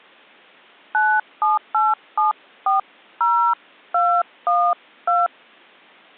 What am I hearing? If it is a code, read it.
DTMF, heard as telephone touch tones, dialled by hand, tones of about 230 ms. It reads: 978740212